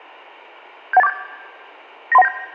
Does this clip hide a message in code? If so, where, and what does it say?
Yes: five-tone selective call (EIA) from 0.9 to 2.3 s, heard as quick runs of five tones, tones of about 30 ms. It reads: 71847 93197